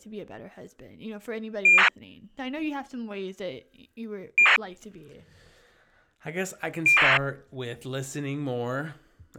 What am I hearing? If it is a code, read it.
ACARS aircraft data, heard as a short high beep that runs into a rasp, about 2400 baud, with speech in English.